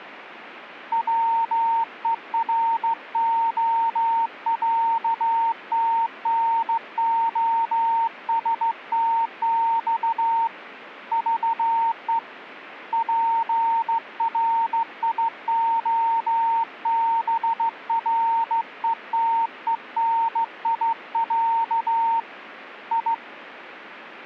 Morse code (Russian alphabet), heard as a keyed tone, hand-sent with a straight key, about 15 wpm, 920 Hz. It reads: ВЕРОЯТНОСТЬ ЖЕ ПРИОБРЕТЕНИЯ И